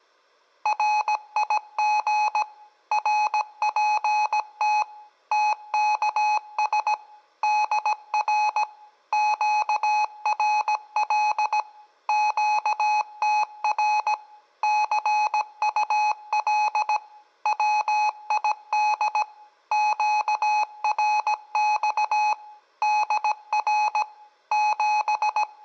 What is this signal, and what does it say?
Morse code, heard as electronic beeps, machine-sent, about 17 wpm, 850 Hz, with room echo. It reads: RIG RPT TKS DR QRL QTR CUL WID QRX DR …